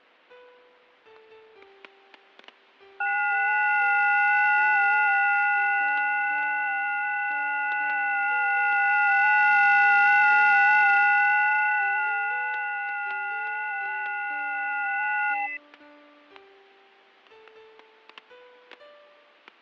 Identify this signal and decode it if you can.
FT8 (several signals at once), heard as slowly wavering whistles, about 6.25 baud, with fading and static crashes.